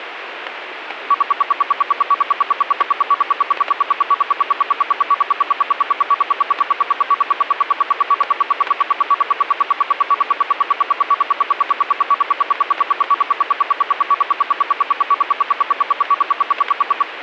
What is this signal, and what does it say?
Radio time signal (RWM, Moscow), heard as ten pulses a second, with radio static and static crashes.